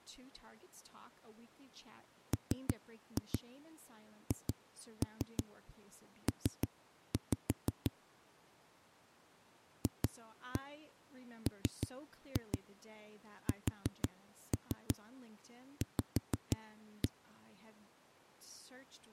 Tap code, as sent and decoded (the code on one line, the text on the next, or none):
3-2 2-3 3-5 / 2-1 3-2 4-3 5-1
MHP FMSV